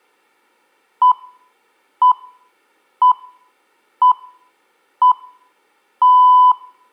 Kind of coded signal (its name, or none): radio time signal